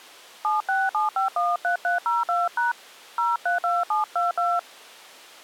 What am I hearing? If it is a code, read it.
DTMF, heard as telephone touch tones, dialled by hand, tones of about 170 ms. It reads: 767513302# 032722